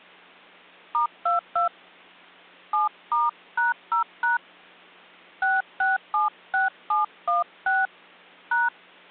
DTMF, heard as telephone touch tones, dialled by hand, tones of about 150 ms. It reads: *22 7*#0# 6676716 #